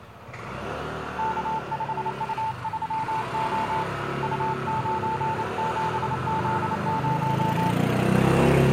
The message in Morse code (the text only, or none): K5U3O U97Z0